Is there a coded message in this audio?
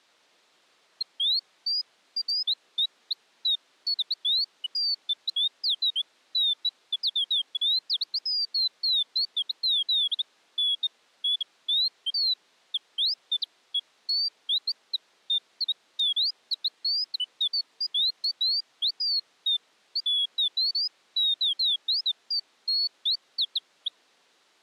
No, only bird-like chirps.